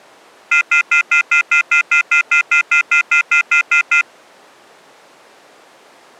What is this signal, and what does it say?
Telephone call progress tone (North American plan), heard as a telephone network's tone, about 1400, 2050, 2450, 2600 Hz, 0.1 s on and 0.1 s off. Off-hook warning tone.